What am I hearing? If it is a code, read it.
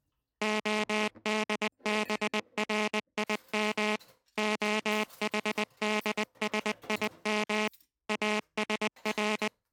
Morse code (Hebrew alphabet), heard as a buzzer, machine-sent, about 20 wpm, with kitchen noise. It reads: הדברים החדשים אשר